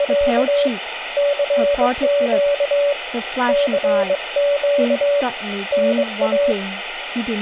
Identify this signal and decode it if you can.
Morse code, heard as a keyed tone, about 22 wpm, 570 Hz, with radio static and speech in English. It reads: … CQ CQ NA